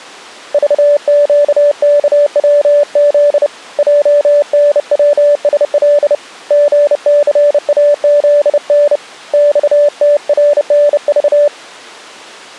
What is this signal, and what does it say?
Morse code, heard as a keyed tone, hand-sent with a bug key, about 30 wpm, 580 Hz. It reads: VQKWZ JNWSL GCAZN XTRNV